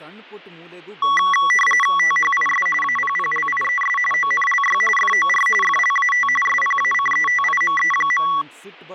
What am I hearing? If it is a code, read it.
RTTY (45.45 baud, 850 Hz shift), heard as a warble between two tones, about 1550 Hz centre, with speech in Kannada. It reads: THIS APPLIES ONLY FOR FLAT SPACETIME.